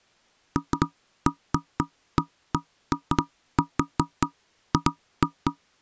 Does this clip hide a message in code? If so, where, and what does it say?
No, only irregular knocks on wood.